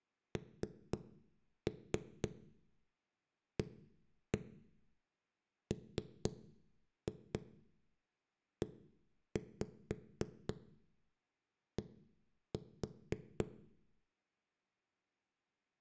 Tap code, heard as knocks on a wall, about 4 knocks a second, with room echo. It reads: NAMED